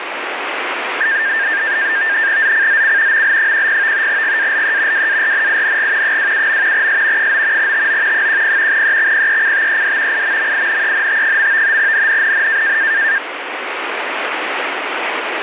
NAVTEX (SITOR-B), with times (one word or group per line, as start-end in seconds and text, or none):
2.4-3.2 ZCZC
3.1-4.1 ML10
4.1-5.1 GALE
4.9-6.2 WARNING
6.0-6.9 27.
6.7-7.3 S
7.2-7.7 9
7.6-8.3 TO
8.1-8.8 10
8.7-10.2 EXPECTED
10.1-11.8 IMMINENT.
11.8-12.8 NNNN